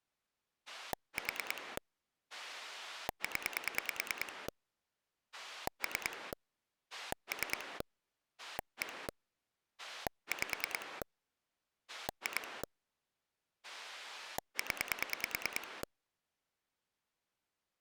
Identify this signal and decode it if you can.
Pulse dialling, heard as a rotary dial, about 9 pulses a second. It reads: 4 0 3 3 1 5 2 0